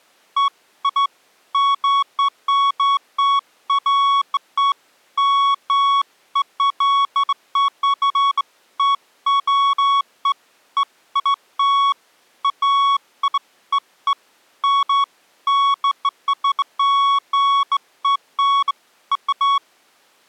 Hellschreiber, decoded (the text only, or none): none